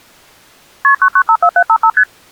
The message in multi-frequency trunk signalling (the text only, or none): KP 9954755 ST